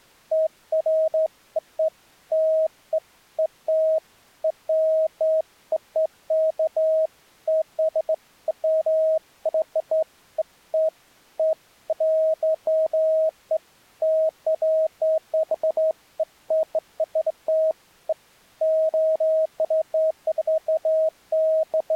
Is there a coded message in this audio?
No, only beeps of irregular length.